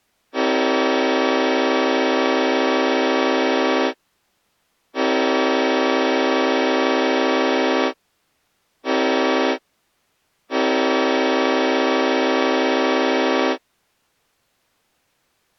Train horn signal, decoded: 2 long, 1 short, 1 long

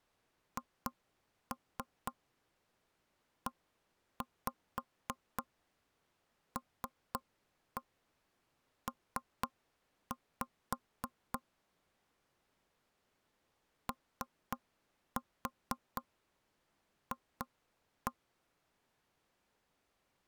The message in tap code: HELP OF

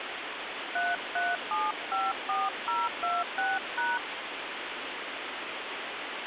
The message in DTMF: 33754026#

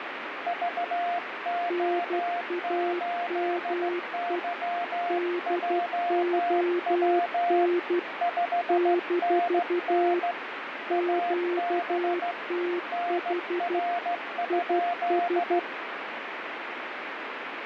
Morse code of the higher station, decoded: VO8YJW 5NN AB NR?

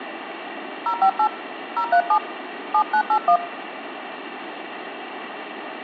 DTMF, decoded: 058 037 7981

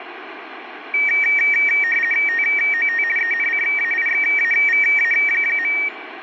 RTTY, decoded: TOT ENCAIXAVA.

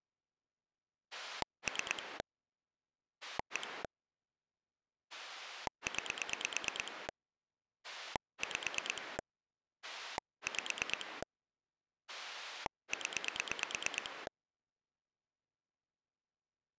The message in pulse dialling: 3 1 9 5 5 0

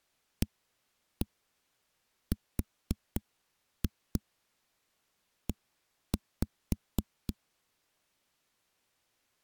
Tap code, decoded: ARE

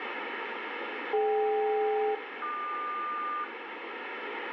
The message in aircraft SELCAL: DK-QS

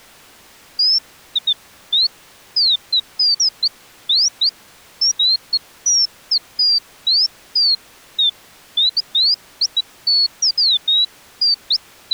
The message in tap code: none

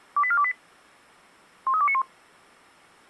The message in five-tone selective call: 28428 13291

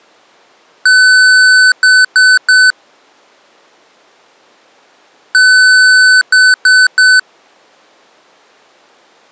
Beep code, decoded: 1 long, 3 short

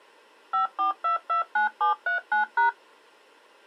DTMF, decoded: 54229739#

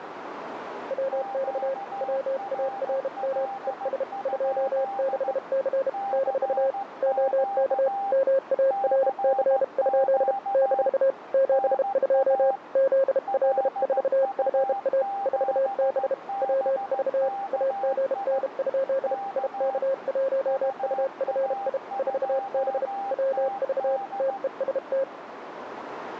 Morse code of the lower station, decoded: WX WARM ES 26C - OK MARC? - 72 ZL4FA 4B WV AGN? IK1UFI 4B WV TEST

